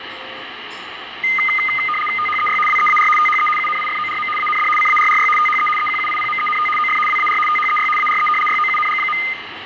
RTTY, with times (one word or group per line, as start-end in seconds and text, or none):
2.2-2.6 THEY
2.7-3.1 WEAR
3.2-3.5 THE
3.6-4.3 UNIFORM
4.4-4.7 AND
4.8-5.3 CARRY
5.4-5.7 THE
5.8-6.7 EQUIPMENT
6.8-7.0 OF
7.1-7.4 WAR
7.5-7.9 THEY
8.0-8.3 ARE
8.5-9.2 YOUNG.